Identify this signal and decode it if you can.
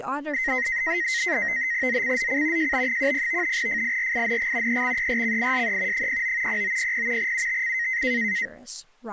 NAVTEX (SITOR-B), 100 baud, 170 Hz shift, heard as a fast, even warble, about 1950 Hz centre, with speech in English. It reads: ZCZC JB10 FIRING EXERCISE 09 0900 UTC